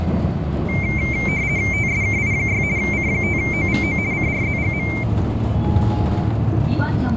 RTTY (50 baud, 170 Hz shift), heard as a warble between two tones, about 2200 Hz centre, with radio static, fading and the noise inside a bus. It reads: TSKI6 C5OVO CRZGM